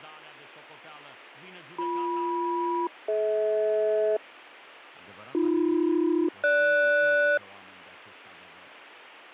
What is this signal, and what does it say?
Aircraft SELCAL, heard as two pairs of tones, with radio static, fading and speech in Romanian. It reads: BM-DH AB-GS